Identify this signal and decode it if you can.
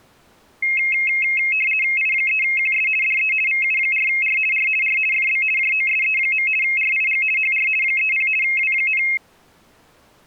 RTTY (50 baud, 450 Hz shift), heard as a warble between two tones, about 2350 Hz centre. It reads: I3QS DE VU4R R R FB JOSE. RIG HR 30 W,